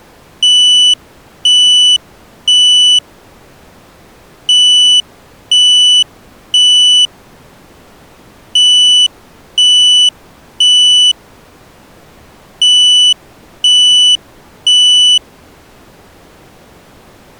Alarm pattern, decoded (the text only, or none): temporal three